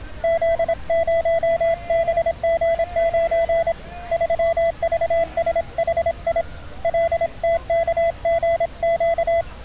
Morse code, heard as a keyed tone, hand-sent with a paddle, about 26 wpm, 670 Hz, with street noise. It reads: Z0BG9 3VSHI LTKGQ